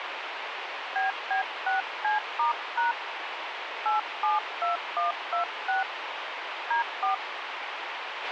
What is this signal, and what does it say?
DTMF, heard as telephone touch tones, dialled by hand, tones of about 140 ms, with radio hiss and a squelch burst at the end. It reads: BB6C*# 872126 D4